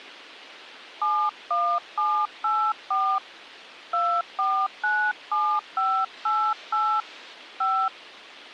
DTMF, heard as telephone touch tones, dialled by hand, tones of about 280 ms. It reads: 71784 2497588 5